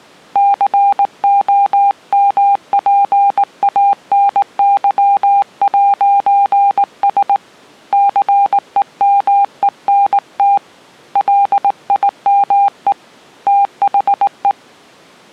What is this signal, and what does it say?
Morse code, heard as a keyed tone, hand-sent with a straight key, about 19 wpm, 800 Hz. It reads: COMPANY'S CEMENT LIME THE